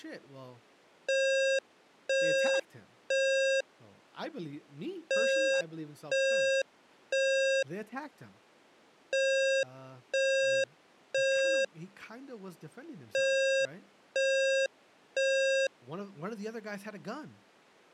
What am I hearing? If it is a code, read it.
Alarm pattern, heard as an alarm's beeps, played four times, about 540 Hz, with speech in English. Temporal three. Smoke or fire, evacuate.